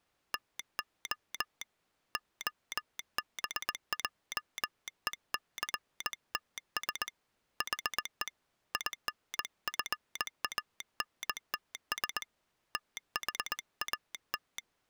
Morse code, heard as a telegraph sounder, hand-sent with a straight key, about 20 wpm. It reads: TO OBJECTS HE INFANTS THAT